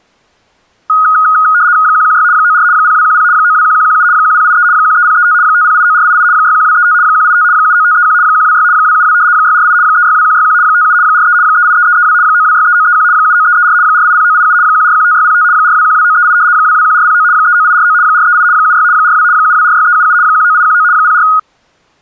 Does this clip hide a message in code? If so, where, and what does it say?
Yes: RTTY (75 baud, 170 Hz shift) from 0.9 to 21.4 s, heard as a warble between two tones, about 1350 Hz centre. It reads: 116 94 0210 921117 1083 13035 5089488 61235 185 79531 126 272 648 362161 57 43 383332 9263931 79334 480987 1415605 4212938 221409 39849 438 76 42 7246377 19819 04